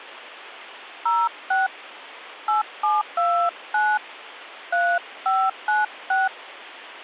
DTMF, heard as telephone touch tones, dialled by hand, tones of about 230 ms. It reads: 06 8729 3596